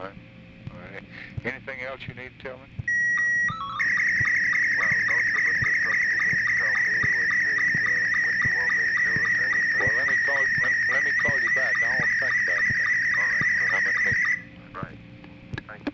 SSTV (slow-scan television), Scottie S2, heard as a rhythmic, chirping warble, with room echo.